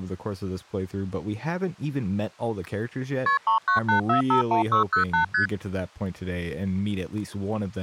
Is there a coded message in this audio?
Yes: multi-frequency trunk signalling (R1, as on North American trunks) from 3.3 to 5.5 s, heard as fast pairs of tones, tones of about 110 ms, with speech in English. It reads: KP 398451608 ST